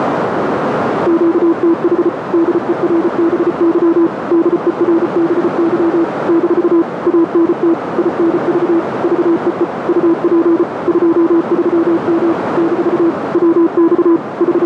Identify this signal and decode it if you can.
Morse code, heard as a keyed tone, machine-sent, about 34 wpm, 330 Hz, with heavy radio static and a narrow filter. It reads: QTH DERBY DERBY - ANT INV VEE UP 23M - WX …